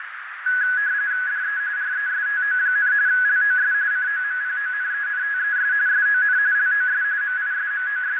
RTTY (45.45 baud, 170 Hz shift), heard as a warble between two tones, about 1600 Hz centre, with radio static and a narrow filter. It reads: DE RESTO, LOS COMPONENTES SON LOS …